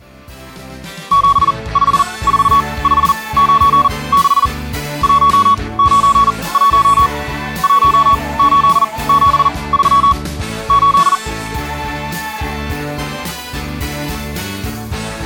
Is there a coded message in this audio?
Yes: Morse code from 1.1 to 11.2 s, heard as a keyed tone, machine-sent, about 40 wpm, spaced as for 24 wpm, 1120 Hz. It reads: 754596 191 1873 8